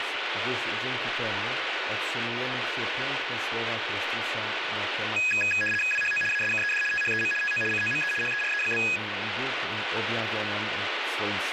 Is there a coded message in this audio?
Yes: RTTY (75 baud, 850 Hz shift) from 5.2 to 9.0 s, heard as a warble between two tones, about 2100 Hz centre, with radio static. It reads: WHO ASKED THEM TO COME HERE?